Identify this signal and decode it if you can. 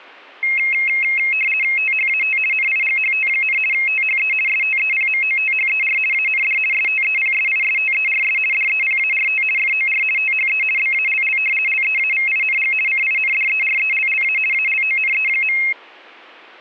RTTY (50 baud, 450 Hz shift), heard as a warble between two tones, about 2350 Hz centre, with static crashes. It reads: THAT NIGHT, THE STEPMOTHER AND STEPSISTERS DEPART FOR THE BALL LEAVING CINDERELLA ALONE.